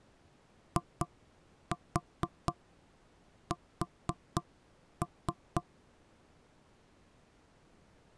Tap code, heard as knocks on wood, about 4 knocks a second. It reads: IS